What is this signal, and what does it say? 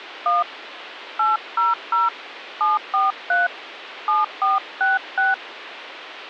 DTMF, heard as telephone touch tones, dialled by hand, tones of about 170 ms, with phone line noise. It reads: 1 800 743 7466